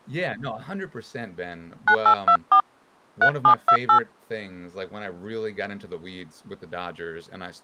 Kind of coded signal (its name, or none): DTMF